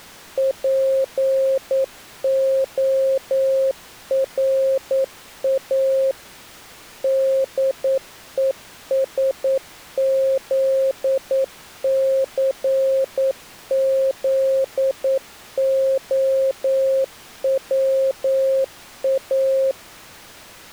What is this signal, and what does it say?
Morse code, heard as a keyed tone, machine-sent, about 9 wpm, 530 Hz. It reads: PORA DESZCZOWA